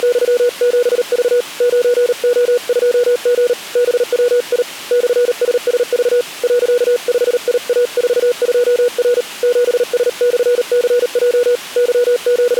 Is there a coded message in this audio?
Yes: Morse code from 0.0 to 12.6 s, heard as a keyed tone, hand-sent with a paddle, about 38 wpm, 490 Hz. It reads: … 9O2G BWI /SSV .5IA42R 7S/CJ …